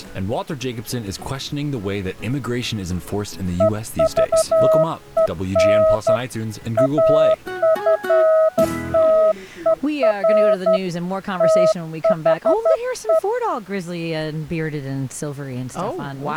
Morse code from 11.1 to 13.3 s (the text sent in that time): THE